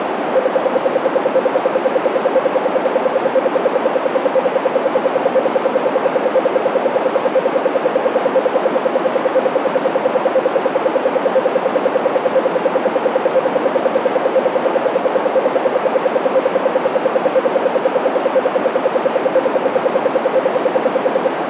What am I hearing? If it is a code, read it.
Radio time signal (RWM, Moscow), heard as ten pulses a second, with radio static and a narrow filter.